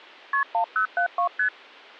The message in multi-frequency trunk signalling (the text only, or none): KP 1072 ST